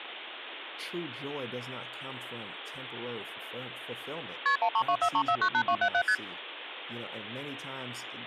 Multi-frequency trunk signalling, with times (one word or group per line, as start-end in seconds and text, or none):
4.5-4.6 KP
4.6-6.0 13243498277
6.1-6.2 ST